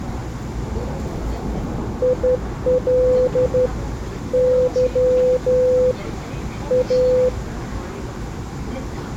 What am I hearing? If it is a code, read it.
Morse code, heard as a keyed tone, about 12 wpm, 500 Hz, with the noise inside a subway train. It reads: IL Y A